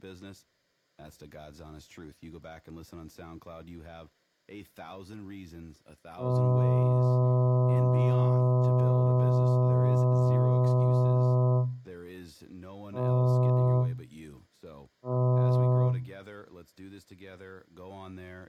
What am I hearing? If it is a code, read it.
Ship horn signal, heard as a ship's horn, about 130 Hz, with speech in English. 1 long, 2 short. At sea: a vessel in fog that is sailing, fishing, towing or hampered.